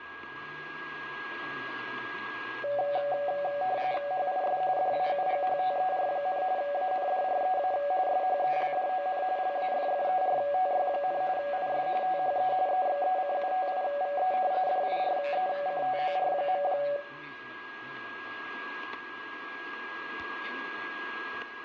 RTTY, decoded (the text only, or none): HIS DAUGHTER, ANDREA SHELDON LAFFERTY, IS THE EXECUTIVE DIRECTOR.